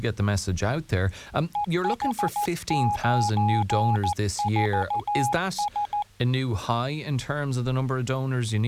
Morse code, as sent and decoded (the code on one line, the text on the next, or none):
. .... ----. ....- ...
EH94S